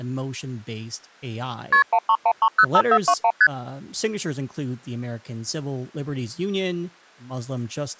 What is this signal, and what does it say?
Multi-frequency trunk signalling (R1, as on North American trunks), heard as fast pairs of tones, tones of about 60 ms, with speech in English. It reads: KP 131305421 ST